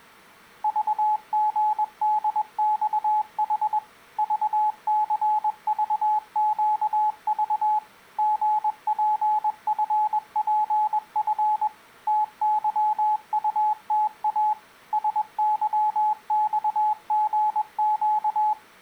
Morse code, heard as a keyed tone, machine-sent, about 21 wpm, 850 Hz. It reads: VGDXH VCVQV GPFPF TYUTA SYXGQ